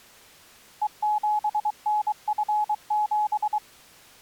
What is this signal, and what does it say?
Morse code, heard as a keyed tone, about 23 wpm, 840 Hz. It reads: E7NF7